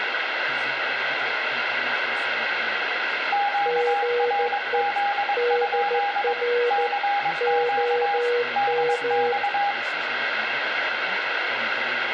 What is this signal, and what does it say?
Morse code, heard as two keyed tones, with radio static, room echo and speech in English. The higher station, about 22 wpm, 810 Hz: QRZ? CQ DX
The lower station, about 14 wpm, 480 Hz: GE DR OM